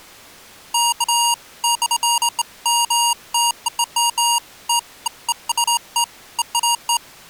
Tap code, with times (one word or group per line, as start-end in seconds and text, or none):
none